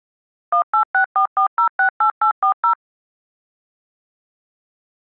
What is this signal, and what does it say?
DTMF, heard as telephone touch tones, dialled by machine, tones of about 100 ms. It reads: 18644068840